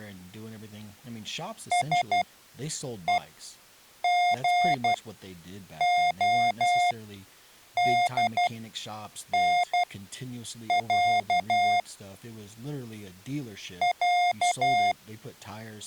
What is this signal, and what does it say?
Morse code (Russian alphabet), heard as electronic beeps, machine-sent, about 12 wpm, spaced as for 7 wpm, 710 Hz, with speech in English. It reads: СЕГОДНЯ Я